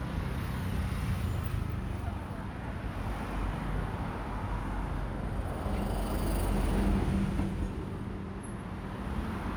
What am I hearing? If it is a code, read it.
Street noise. There is no code.